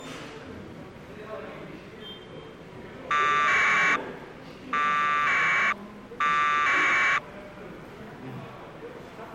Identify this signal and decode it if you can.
Packet radio (AX.25, as in APRS), 1200 baud, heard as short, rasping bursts, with the noise of a subway station.